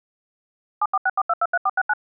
DTMF, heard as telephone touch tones, dialled by machine, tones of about 40 ms. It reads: 7464223469